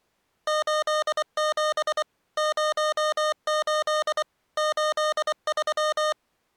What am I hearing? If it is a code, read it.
Morse code, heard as electronic beeps, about 24 wpm, 610 Hz. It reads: 87 08 83